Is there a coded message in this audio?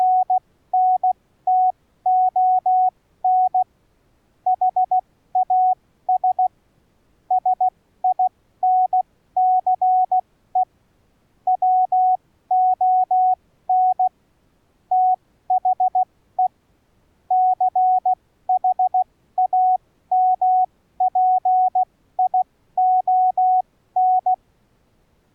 Yes: Morse code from 0.0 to 24.4 s, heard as a keyed tone, machine-sent, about 16 wpm, spaced as for 13 wpm, 740 Hz. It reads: … HAS SINCE WON THE CHAMPION